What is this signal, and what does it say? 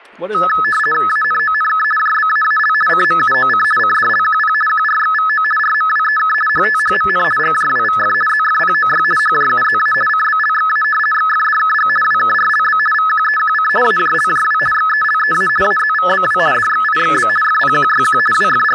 RTTY (50 baud, 450 Hz shift), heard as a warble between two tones, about 1500 Hz centre, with static crashes and speech in English. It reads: ANONK JBAAL CMUOC CDLQP QRXVO RMWEK HTHMN GJWVF ZFPOY HJUZA CBLXA XFDKG WKRLB VQEQC AJLJW XELEA AZVBW DXIXB FPQYQ …